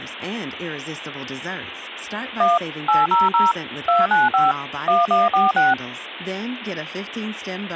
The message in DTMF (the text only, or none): 1 800 295 1146